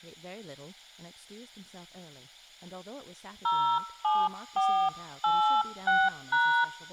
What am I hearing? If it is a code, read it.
DTMF, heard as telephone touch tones, dialled by hand, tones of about 300 ms, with speech in English. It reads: 07486#